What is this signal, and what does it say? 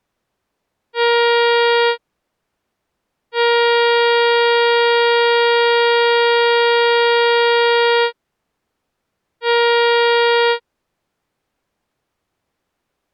Ship horn signal, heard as a ship's horn, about 470 Hz. 1 short, 1 long, 1 short. At sea: a vessel at anchor warns of its position.